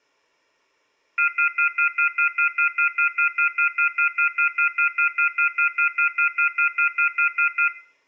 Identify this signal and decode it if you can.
Telephone call progress tone (North American plan), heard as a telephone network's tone, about 1400, 2050, 2450, 2600 Hz, 0.1 s on and 0.1 s off, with room echo. Off-hook warning tone.